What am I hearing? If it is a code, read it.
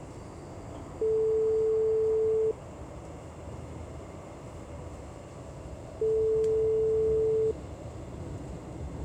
Telephone call progress tone (single-tone plan, as in most of Europe), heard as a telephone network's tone, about 440 Hz, 1.5 s on and 3.5 s off, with the noise inside a subway train. Ringback tone.